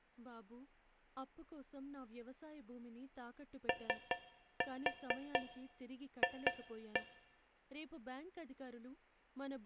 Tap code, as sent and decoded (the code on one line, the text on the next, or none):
3-4 2-1
OF